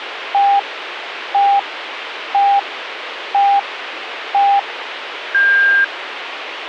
Radio time signal (five pips and a higher one, as on Chinese radio), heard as pips, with radio hiss.